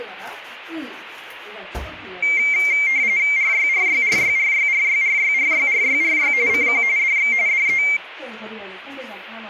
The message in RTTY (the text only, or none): RYRYRYRYRYRYRYRYRY CQ DX DE